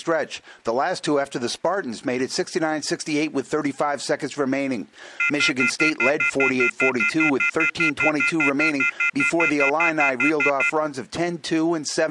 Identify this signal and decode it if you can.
Telephone call progress tone (North American plan), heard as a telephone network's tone, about 1400, 2050, 2450, 2600 Hz, 0.1 s on and 0.1 s off. Off-hook warning tone.